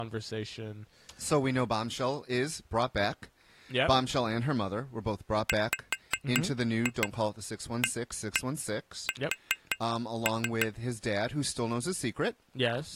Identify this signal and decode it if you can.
Tap code, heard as taps on glass, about 5 knocks a second, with speech in English. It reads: WAS